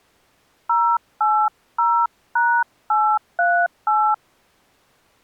DTMF, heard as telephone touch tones, dialled by hand, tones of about 280 ms. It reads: 080#838